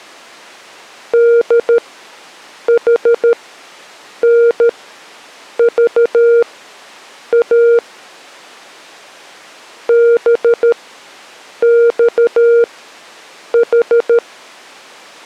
Morse code, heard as a keyed tone, machine-sent, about 13 wpm, spaced as for 7 wpm, 470 Hz. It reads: DHNVA BXH